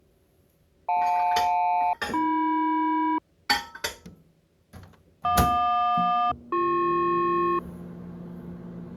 Aircraft SELCAL, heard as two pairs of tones, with kitchen noise. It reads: JL-AM JQ-BP